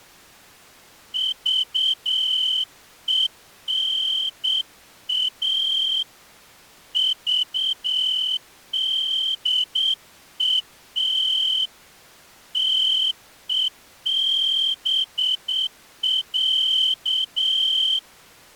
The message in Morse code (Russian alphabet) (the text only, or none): ЖЕНА ЖДЕТ ТЕБЯ